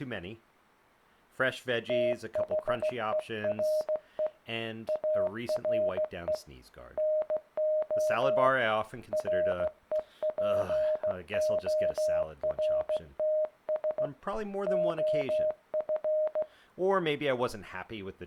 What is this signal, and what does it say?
Morse code, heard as a keyed tone, hand-sent with a straight key, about 16 wpm, 620 Hz, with room echo and speech in English. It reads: THERE ARE NO REPORTS OF